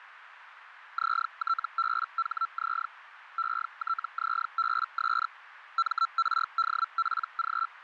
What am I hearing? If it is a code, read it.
Hellschreiber (Feld-Hell, 122.5 baud), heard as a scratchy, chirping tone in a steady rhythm, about 1340 Hz, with radio static and a narrow filter. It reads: ZTBHZ ETZBS MRDPG